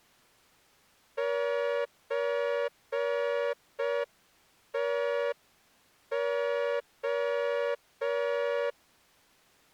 Morse code (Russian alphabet), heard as a horn, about 5 wpm. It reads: ЧТО